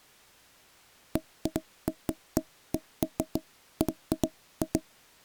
Irregular knocks on wood. There is no code.